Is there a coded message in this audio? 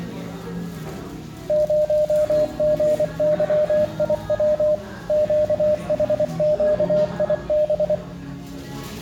Yes: Morse code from 1.4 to 8.0 s, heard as a keyed tone, machine-sent, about 24 wpm, 610 Hz, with room echo and the noise of a restaurant. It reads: 0GYIW QHQIB